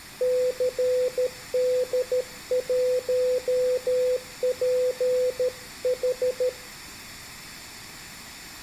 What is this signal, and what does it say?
Morse code, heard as a keyed tone, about 13 wpm, 500 Hz. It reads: CD1PH